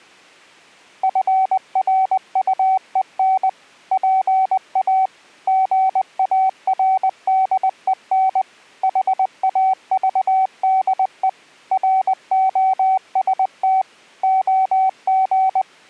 Morse code, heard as a keyed tone, machine-sent, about 20 wpm, 760 Hz. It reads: FRUEN PA GARDEN HAVDE ROST OG